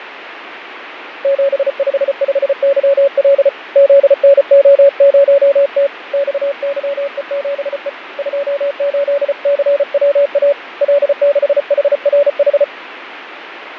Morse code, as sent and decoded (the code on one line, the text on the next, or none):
--... ..... ..... -.-- .-.. / --.. -. --- ----- - / -..- -.-- . --... . / ..--- ---.. -.-. .-- .- / .-.. -.... .... .-. ....
755YL ZNO0T XYE7E 28CWA L6HRH